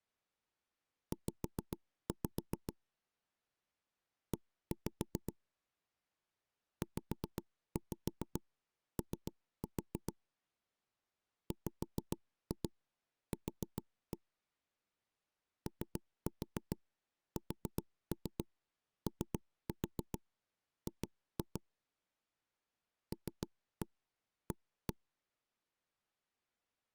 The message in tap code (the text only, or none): Z E ZO WQ OSOG LA